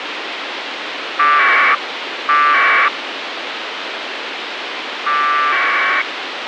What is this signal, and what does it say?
Packet radio (AX.25, as in APRS), 1200 baud, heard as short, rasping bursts, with radio hiss.